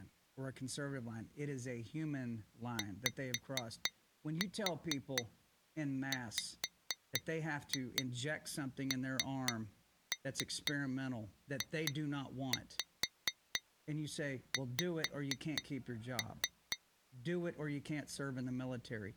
Tap code, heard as taps on glass, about 4 knocks a second, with speech in English. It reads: YWNJX